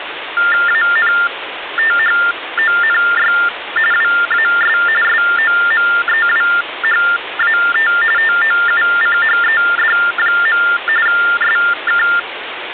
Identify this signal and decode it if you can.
TTY/TDD text telephone tones (45.45 baud Baudot), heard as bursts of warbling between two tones, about 400 Hz shift, 1600 Hz centre, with phone line noise. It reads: ANTHONY WAS SOMEWHAT TOUCHED. SK